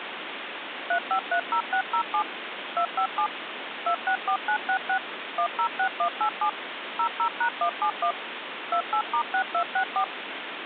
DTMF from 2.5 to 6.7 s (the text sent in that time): 257 264966 106187